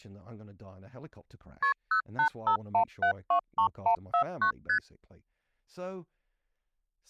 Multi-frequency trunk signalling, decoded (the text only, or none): KP 0851723149 ST